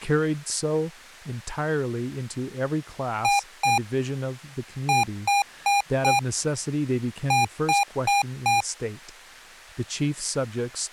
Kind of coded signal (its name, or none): beep code